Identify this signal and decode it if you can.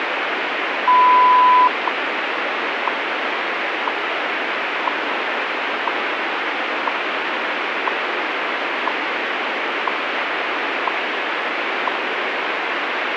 Radio time signal (WWV, Colorado), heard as ticks, one a second, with radio static.